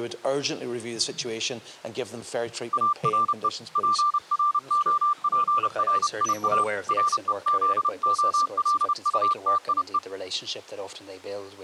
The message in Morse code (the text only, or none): ARE PROPRIA REZOLUTIE